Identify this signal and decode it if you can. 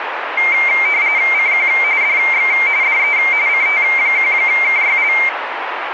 RTTY (45.45 baud, 170 Hz shift), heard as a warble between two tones, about 2200 Hz centre, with radio static. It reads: CQ DX DE CT1KYL